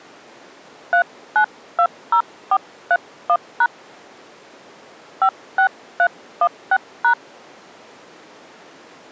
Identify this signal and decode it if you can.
DTMF, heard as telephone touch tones, dialled by hand, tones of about 70 ms. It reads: 3920431# 56316#